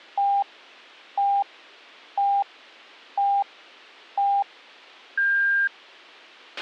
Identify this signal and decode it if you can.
Radio time signal (five pips and a higher one, as on Chinese radio), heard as pips, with a squelch burst at the end.